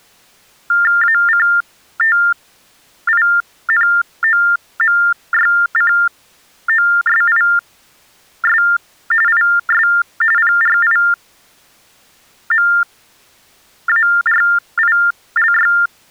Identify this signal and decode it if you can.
TTY/TDD text telephone tones (45.45 baud Baudot), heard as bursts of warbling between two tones, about 400 Hz shift, 1600 Hz centre. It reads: ACTINOMYCOSIS IS PRIMARILY